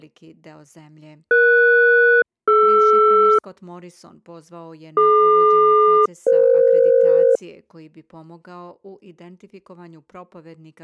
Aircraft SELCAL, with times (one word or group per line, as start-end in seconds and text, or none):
1.3-3.4 ES-DR
5.0-7.4 DQ-EF